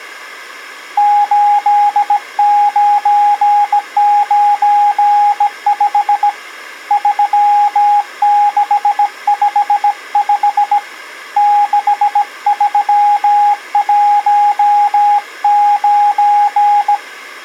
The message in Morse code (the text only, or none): 8995 3655 6319